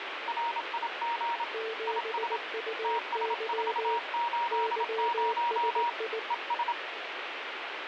Morse code, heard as two keyed tones, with radio static. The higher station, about 27 wpm, 940 Hz: RIG IS TS480 ES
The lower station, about 19 wpm, 440 Hz: 7UY YSI